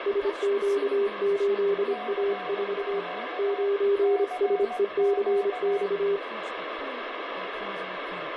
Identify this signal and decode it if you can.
Morse code, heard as two keyed tones, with radio static and speech in English. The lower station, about 26 wpm, 400 Hz: SQ8A4 9SECX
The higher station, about 18 wpm, 730 Hz: CQ CQ